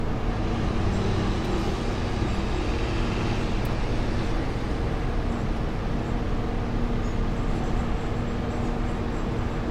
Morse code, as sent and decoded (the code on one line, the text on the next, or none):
none